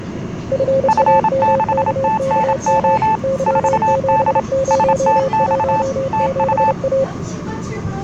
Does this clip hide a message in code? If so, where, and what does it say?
Yes: Morse code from 0.5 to 7.1 s, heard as two keyed tones, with the noise inside a subway train. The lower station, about 30 wpm, 540 Hz: FAMKKM Y7017A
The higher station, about 27 wpm, 880 Hz: F6TNO 4D STX TU